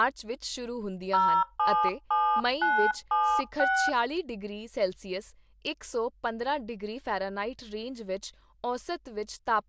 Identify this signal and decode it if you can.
DTMF, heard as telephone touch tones, dialled by hand, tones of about 300 ms, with speech in Punjabi. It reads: 077976